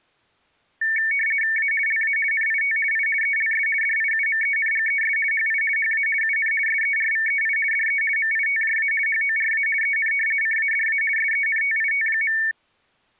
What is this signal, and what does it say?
RTTY (50 baud, 450 Hz shift), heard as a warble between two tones, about 2000 Hz centre. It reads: A LA NIT I ELS DIUMENGES HI HA UN SERVEI DE MITJA HORA EN CADA SENTIT.